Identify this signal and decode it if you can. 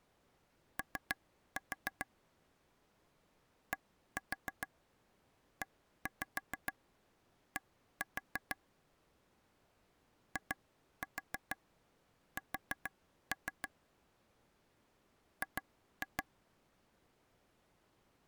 Tap code, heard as taps on a table, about 6 knocks a second. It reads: O DED IS G